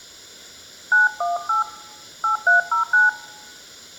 DTMF, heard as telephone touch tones, dialled by hand, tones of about 130 ms. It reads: 918 8309